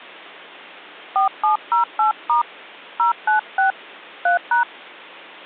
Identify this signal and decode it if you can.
DTMF, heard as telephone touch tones, dialled by hand, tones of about 120 ms. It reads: 4708* 096 3#